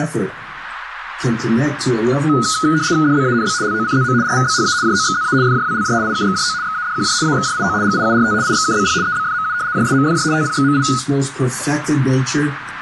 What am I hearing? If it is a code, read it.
RTTY (75 baud, 170 Hz shift), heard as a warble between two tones, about 1360 Hz centre, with radio static and a narrow filter. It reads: DBANB LOCZM RVBHA JOXZA FJWLJ IKXJO XADQJ AXJIO GIURT IXKBP EBFMU JSMFJ TPXMI